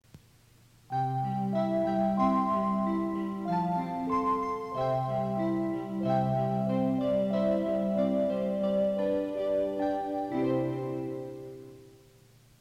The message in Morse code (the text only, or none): none